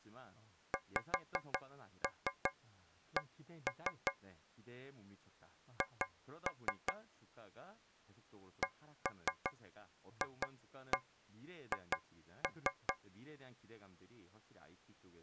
Tap code, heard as taps on a metal pipe, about 5 knocks a second, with speech in Korean. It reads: XC H CFH